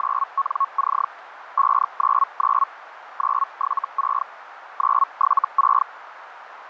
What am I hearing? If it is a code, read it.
Hellschreiber (Feld-Hell, 122.5 baud), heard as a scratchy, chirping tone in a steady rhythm, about 1100 Hz, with radio static and a narrow filter. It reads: … 599 976 976